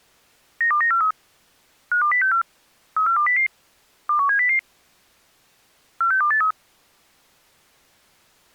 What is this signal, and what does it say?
Five-tone selective call (CCIR), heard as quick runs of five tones, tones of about 100 ms. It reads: 92943 52064 34200 21700 46283